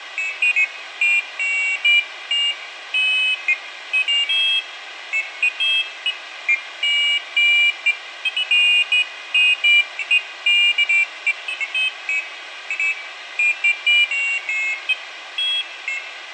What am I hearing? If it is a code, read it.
Pairs of high tones at irregular times, with radio hiss and room echo. There is no code.